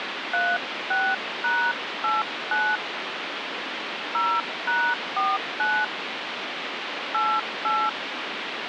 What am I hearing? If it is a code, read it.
DTMF, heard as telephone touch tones, dialled by hand, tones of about 220 ms, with phone line noise. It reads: 36#89 0#49 88